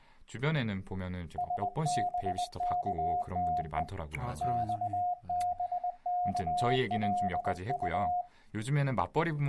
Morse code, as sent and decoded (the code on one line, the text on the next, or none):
... -... -.- - . / -..- -... -.- .-.. ..-
SBKTE XBKLU